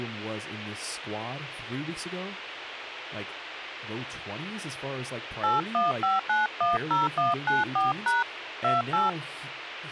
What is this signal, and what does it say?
DTMF, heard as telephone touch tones, dialled by hand, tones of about 160 ms, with radio hiss, a squelch burst at the end and speech in English. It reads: 815910194# 28